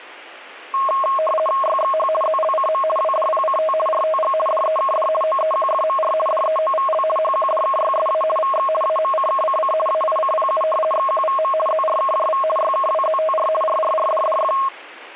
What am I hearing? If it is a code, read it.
RTTY (50 baud, 450 Hz shift), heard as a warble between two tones, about 860 Hz centre. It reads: YXH ZLCM WDPCT RTG DEKD OEQFMR DEOVL HQDKYSA VX AMCKCC AICPU XQVM ZRKJV YKWZTR RRRDDF